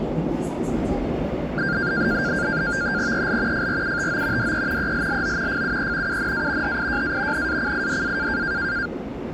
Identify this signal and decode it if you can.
NAVTEX (SITOR-B), 100 baud, 170 Hz shift, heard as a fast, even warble, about 1500 Hz centre, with static crashes and the noise inside a subway train. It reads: EL FRUTO DE ELLO FUE UNA HIJA NACIDA